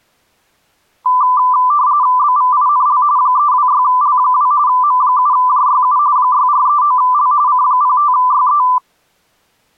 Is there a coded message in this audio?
Yes: RTTY (45.45 baud, 170 Hz shift) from 1.1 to 8.8 s, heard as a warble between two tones, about 1090 Hz centre. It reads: BVINL 326L2 M7JYU 6439L C05YE